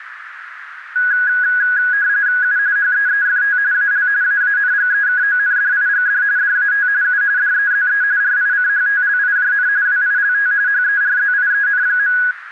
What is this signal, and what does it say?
RTTY (45.45 baud, 170 Hz shift), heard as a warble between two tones, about 1550 Hz centre, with radio static and a narrow filter. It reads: U HEEFT AL AANGEKONDIGD DAT U DEZE RICHTLIJN WILT HERZIEN.